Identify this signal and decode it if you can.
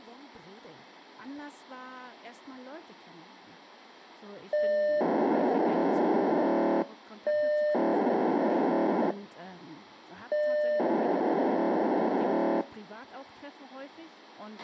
POCSAG pager data (1200 baud), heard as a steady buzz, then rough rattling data, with a squelch burst at the end.